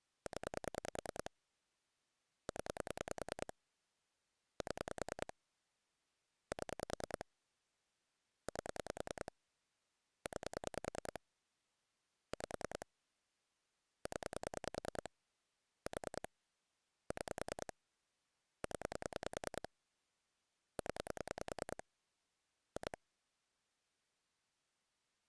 Pulse dialling, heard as clicks on a phone line, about 10 pulses a second. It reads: 0 0 7 7 8 9 5 0 4 6 0 0 2